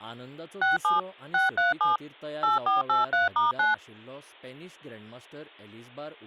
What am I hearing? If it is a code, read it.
DTMF, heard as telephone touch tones, dialled by machine, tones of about 150 ms, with speech in Goan Konkani. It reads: 67 637 8483*9